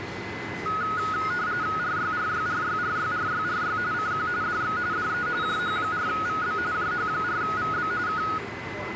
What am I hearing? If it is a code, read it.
RTTY (45.45 baud, 170 Hz shift), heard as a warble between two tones, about 1360 Hz centre, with a steady whistle near 2030 Hz and the noise of a subway station. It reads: RYRYRYRYRYRY CQ DX DE JH4VB JH4VB K